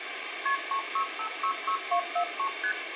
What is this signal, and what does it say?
Multi-frequency trunk signalling (R1, as on North American trunks), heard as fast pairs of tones, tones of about 80 ms, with phone line noise and room echo. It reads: KP 36566243 ST